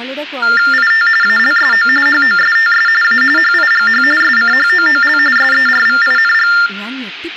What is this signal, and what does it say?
TTY/TDD text telephone tones (45.45 baud Baudot), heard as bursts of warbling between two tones, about 400 Hz shift, 1600 Hz centre, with hum, room echo and speech in Malayalam. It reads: IT ALSO HOSTS A HIGH SCHOOL SERVING